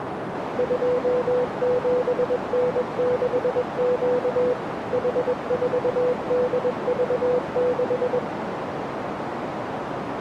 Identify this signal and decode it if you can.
Morse code, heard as a keyed tone, machine-sent, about 21 wpm, 500 Hz, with radio static and a narrow filter. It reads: 27N6Q H4DV6